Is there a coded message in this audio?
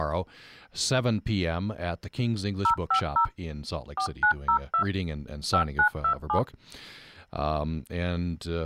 Yes: DTMF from 2.6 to 6.4 s, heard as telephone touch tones, dialled by machine, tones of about 90 ms, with speech in English. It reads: 050 4902 5927